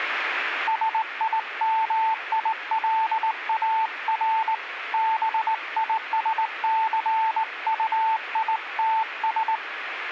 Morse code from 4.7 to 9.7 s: BISCUITS

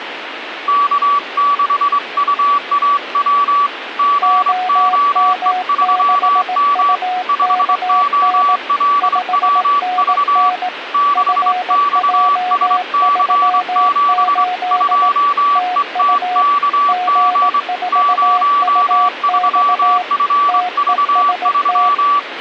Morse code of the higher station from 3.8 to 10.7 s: GOE3M 5OLWV

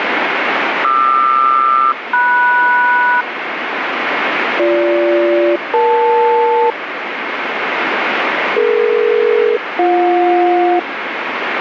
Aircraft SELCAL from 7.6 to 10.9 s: DE-BJ

